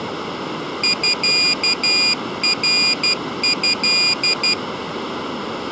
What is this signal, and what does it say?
Morse code (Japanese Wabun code), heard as a high beeper, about 12 wpm, 2450 Hz. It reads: ミナト